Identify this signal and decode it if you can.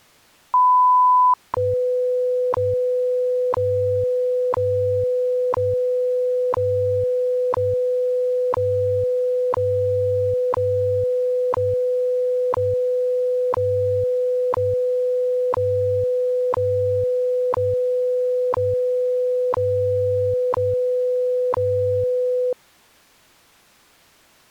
Radio time signal (WWV, Colorado), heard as ticks, one a second.